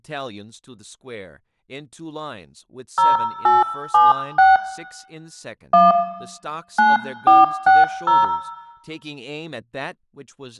DTMF, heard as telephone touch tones, dialled by hand, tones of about 180 ms, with room echo and speech in English. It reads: 0876 1 9460